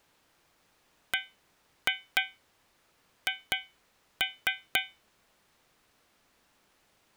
Tap code, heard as taps on a metal pipe, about 4 knocks a second. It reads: BH